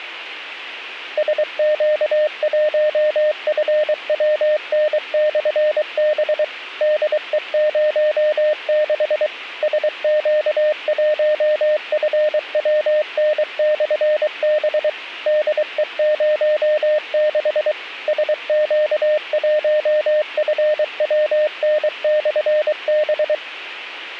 Morse code, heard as a keyed tone, machine-sent, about 23 wpm, 610 Hz. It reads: SQ1FWN/B DE06 SQ1FWN/B DE06 SQ1FWN/B